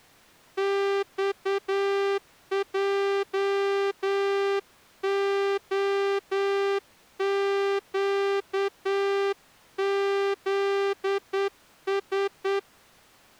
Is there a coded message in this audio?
Yes: Morse code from 0.5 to 12.7 s, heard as a horn, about 9 wpm. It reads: XJOQZS